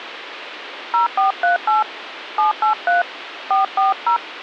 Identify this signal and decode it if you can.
DTMF, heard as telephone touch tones, dialled by hand, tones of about 130 ms, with phone line noise. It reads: 0438 783 440